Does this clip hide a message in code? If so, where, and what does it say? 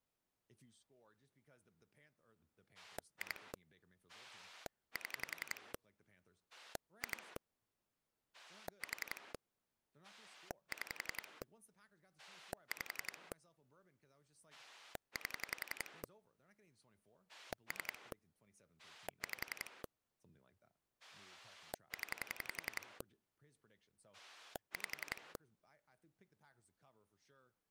Yes: pulse dialling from 2.8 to 25.4 s, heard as a rotary dial, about 11 pulses a second, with speech in English. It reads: 2 7 2 4 6 5 8 3 5 0 5